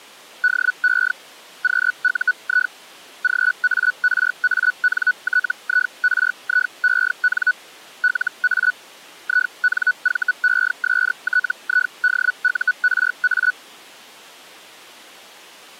Hellschreiber (Feld-Hell, 122.5 baud), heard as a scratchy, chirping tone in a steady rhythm, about 1480 Hz. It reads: DE QUI GARANTIRIEN LA INVESTIDURA